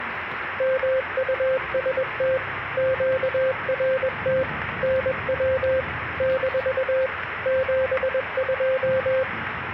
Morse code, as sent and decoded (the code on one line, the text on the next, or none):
-- ..- ... - / --.- .-. - / -. .-- / -....- / --... ..---
MUST QRT NW - 72